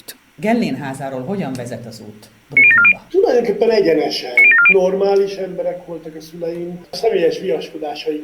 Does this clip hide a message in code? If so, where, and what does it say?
Yes: five-tone selective call (ZVEI) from 2.6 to 4.7 s, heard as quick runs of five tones, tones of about 70 ms. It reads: 90740 90740